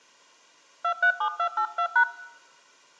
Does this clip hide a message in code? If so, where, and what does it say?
Yes: DTMF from 0.8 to 2.0 s, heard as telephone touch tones, dialled by hand, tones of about 80 ms. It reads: 237282#